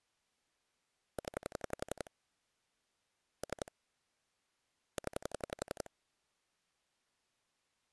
Pulse dialling, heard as clicks on a phone line, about 11 pulses a second. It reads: 0 3 0